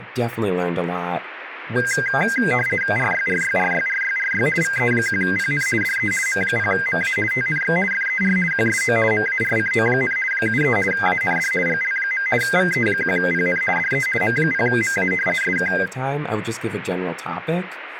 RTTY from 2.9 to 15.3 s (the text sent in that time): RYRYRYRYRY VE1PN DE M0MA TNX FER QSO MARCO, 73 AND GL. VE1PN DE M0MA